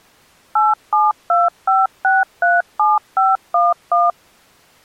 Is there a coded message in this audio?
Yes: DTMF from 0.6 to 4.1 s, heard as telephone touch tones, dialled by machine, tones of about 190 ms. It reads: 8725637511